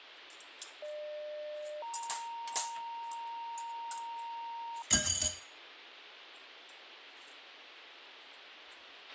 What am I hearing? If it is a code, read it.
Two-tone page, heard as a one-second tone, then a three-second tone, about 600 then 930 Hz, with radio hiss, a squelch burst at the end and kitchen noise.